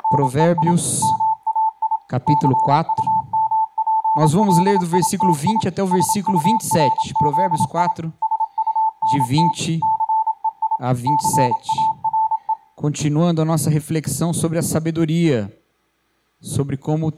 Morse code, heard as a keyed tone, machine-sent, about 27 wpm, 880 Hz. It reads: … MAI CUMPLITI SURZI SUNT CEI CARE